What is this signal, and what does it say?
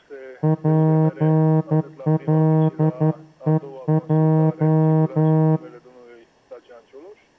Morse code, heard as a horn, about 11 wpm. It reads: PLEJ